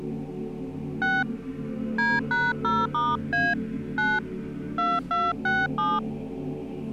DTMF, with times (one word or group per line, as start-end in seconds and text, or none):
1.0-1.2 6
2.0-3.5 D#0*A
4.0-4.2 9
4.8-6.0 2267